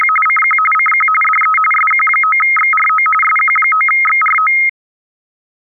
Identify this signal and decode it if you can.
RTTY (45.45 baud, 850 Hz shift), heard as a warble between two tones, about 1700 Hz centre. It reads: … CQ CQ DE SQ9XRO SQ9XRO